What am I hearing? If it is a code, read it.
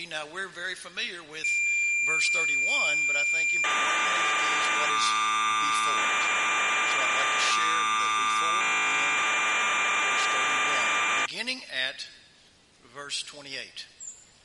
Cassette data (Kansas City type), 1200 baud, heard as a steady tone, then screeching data.